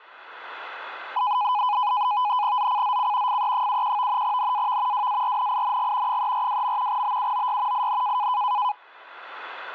NAVTEX (SITOR-B), 100 baud, 170 Hz shift, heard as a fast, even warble, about 920 Hz centre. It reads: ZCZC FE71 NAV WARNING 342. BUOY IN